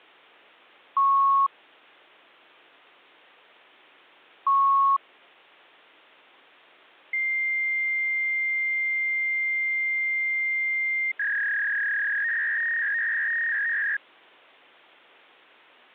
Fax machine handshake, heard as beeps, a long tone and a warble.